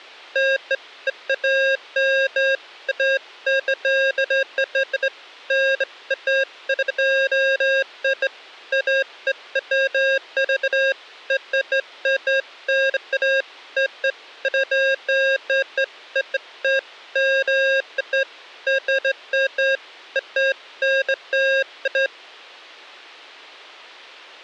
Beeps of irregular length. There is no code.